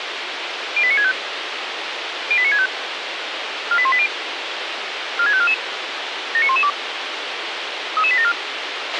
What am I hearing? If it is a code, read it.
Five-tone selective call (ZVEI), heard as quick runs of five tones, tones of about 70 ms, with radio hiss and a squelch burst at the end. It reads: 08965 08965 48180 46544 79112 33874